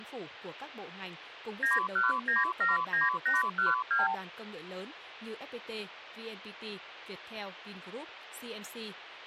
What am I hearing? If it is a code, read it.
Multi-frequency trunk signalling (R2, with the far end's replies), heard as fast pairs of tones, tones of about 160 ms, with phone line noise and speech in Vietnamese. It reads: 91979812